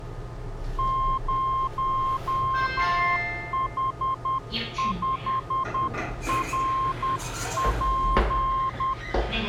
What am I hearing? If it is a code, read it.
Morse code, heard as a keyed tone, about 10 wpm, 1060 Hz, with the noise inside a lift. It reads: 0H5RP